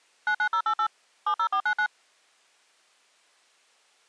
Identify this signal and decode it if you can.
DTMF, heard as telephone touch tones, dialled by machine, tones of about 80 ms. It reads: 99088 70499